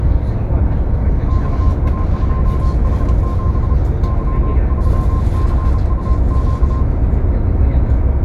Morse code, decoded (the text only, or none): XA2H7 Y3CUQ